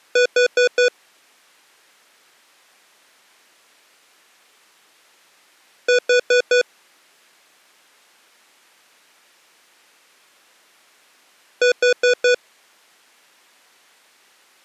Alarm pattern, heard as an alarm's beeps, played three times, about 490 Hz. Temporal four. Carbon monoxide.